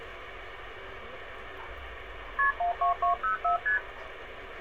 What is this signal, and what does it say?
Multi-frequency trunk signalling (R1, as on North American trunks), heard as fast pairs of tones, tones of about 120 ms, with phone line noise and street noise. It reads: KP 12204 ST